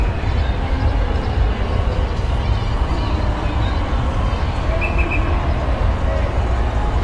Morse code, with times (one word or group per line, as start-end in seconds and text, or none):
none